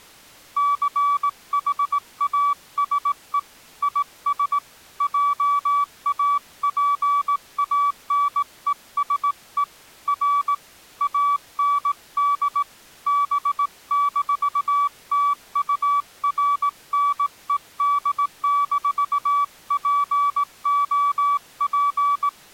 Morse code, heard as a keyed tone, hand-sent with a straight key, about 18 wpm, 1150 Hz. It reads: CHASE IS JAPANESE R AND B-TURNED-POP